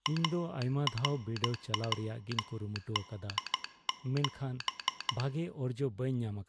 Morse code, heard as a telegraph sounder, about 13 wpm, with speech in Santali. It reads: ARWD7